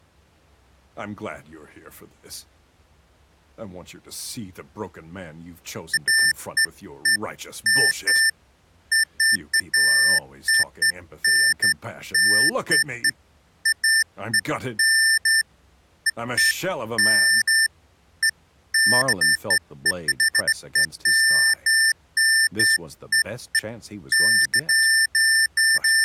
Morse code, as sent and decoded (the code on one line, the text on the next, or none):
none